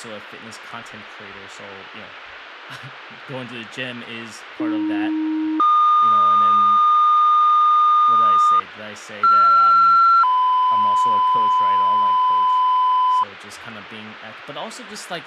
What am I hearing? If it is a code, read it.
Two-tone page, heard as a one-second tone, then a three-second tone, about 310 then 1220 Hz, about 1360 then 1010 Hz, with speech in English.